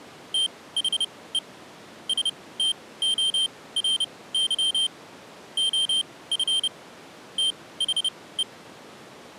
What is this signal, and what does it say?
Morse code, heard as a high beeper, machine-sent, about 30 wpm, spaced as for 19 wpm, 3150 Hz. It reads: THE STORY OF THE